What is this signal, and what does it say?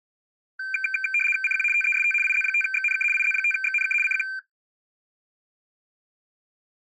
RTTY (75 baud, 850 Hz shift), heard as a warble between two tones, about 1950 Hz centre. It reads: CQ TEST IZ5XNK IZ5XNK CQ